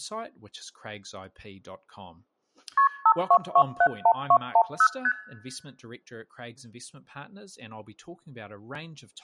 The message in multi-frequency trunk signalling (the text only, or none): KP 52271210 ST